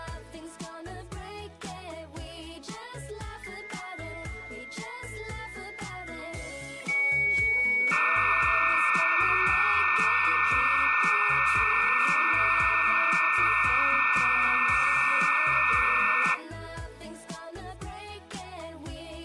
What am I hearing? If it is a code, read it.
Dial-up modem handshake (low-speed, two carriers), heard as two whistles, then hiss.